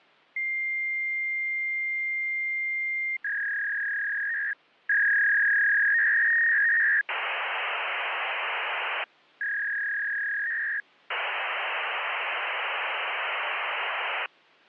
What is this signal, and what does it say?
Fax machine handshake, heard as a long tone, a warble and hiss.